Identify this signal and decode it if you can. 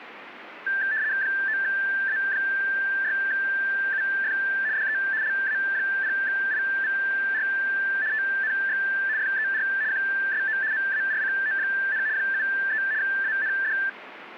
RTTY (75 baud, 170 Hz shift), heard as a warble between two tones, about 1650 Hz centre, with radio static. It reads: 9A6UF DE LA0IVR TNX FER QSO MARCO, 73 AND